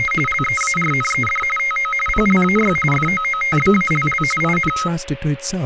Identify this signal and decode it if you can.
RTTY (45.45 baud, 850 Hz shift), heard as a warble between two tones, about 1700 Hz centre, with a steady whistle near 550 Hz and speech in English. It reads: … LEARNED TO PLAY FOOTBALL IN